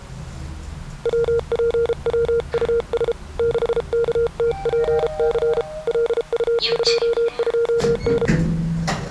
Morse code, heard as a keyed tone, hand-sent with a paddle, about 33 wpm, 470 Hz, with the noise inside a lift. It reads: WPWUS 6KTPC LU22N